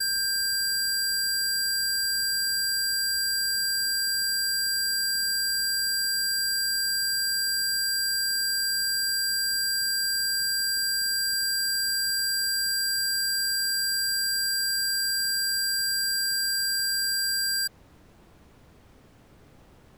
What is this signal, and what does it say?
A steady tone. There is no code.